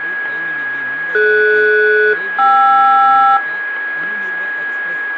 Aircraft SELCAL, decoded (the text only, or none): DS-KR